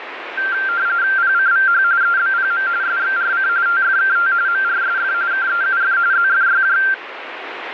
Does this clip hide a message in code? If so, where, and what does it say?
Yes: RTTY (45.45 baud, 170 Hz shift) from 0.4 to 6.9 s, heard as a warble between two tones, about 1480 Hz centre, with radio static. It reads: PCVH EBPM SXRC TFKT MRSF KEUF ZFYJ